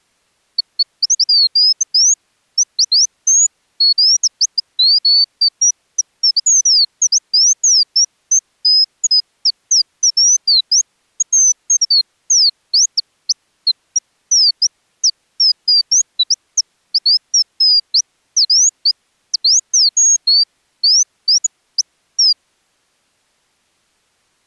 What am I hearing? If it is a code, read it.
Bird-like chirps. There is no code.